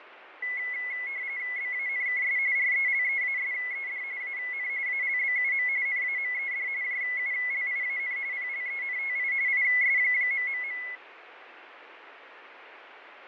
RTTY (45.45 baud, 170 Hz shift), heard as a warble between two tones, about 2100 Hz centre, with radio static and fading. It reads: BANKS RELEASED AN ALBUM NAMED JULIAN PLENTI IS...